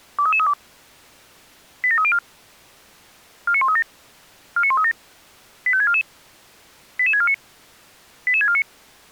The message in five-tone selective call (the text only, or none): 23332 87304 49137 49137 85644 88649 88649